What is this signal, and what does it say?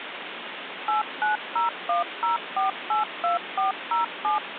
DTMF, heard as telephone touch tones, dialled by machine, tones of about 140 ms, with phone line noise. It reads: 89010482407